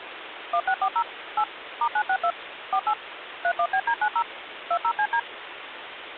DTMF, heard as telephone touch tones, dialled by machine, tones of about 70 ms, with phone line noise. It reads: 1640 8 *962 48 31BD90 20CD